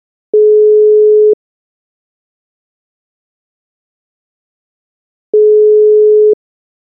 Telephone call progress tone (single-tone plan, as in most of Europe), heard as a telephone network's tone, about 420 Hz, 1 s on and 4 s off. Ringback tone.